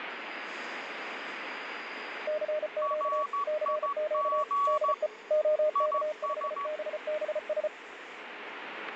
Morse code, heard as two keyed tones, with radio static and the noise inside a subway train. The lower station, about 34 wpm, 610 Hz: CQ CQ DE OK5BBS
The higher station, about 14 wpm, 1130 Hz: RIG IS